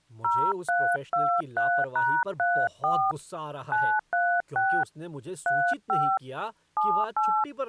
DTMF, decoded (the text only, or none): 0323#34 936 35 78